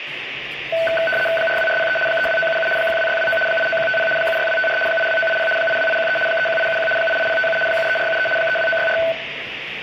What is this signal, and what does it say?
RTTY (75 baud, 850 Hz shift), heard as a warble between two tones, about 1080 Hz centre, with radio static, room echo and the noise of a restaurant. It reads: 42403 32977 12629 89150 76254 82980 82813 31871 88057 73473 32964